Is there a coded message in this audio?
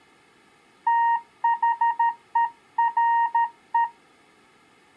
Yes: Morse code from 0.8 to 3.9 s, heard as a keyed tone, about 13 wpm, 930 Hz. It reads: THERE